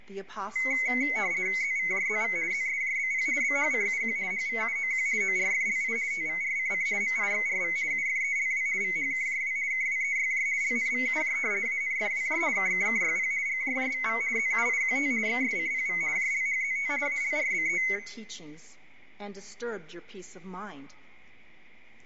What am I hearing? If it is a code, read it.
RTTY (50 baud, 170 Hz shift), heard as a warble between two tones, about 2150 Hz centre, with room echo. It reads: ZVJZV ZSJBP BHCUQ HVUOQ ORFLI TVRCC MIXRV UFELW VHKJW KWEYJ LNVUJ ANFWJ KKKYP GJJVV ZUIQT XSCPV JLHZT ALRBE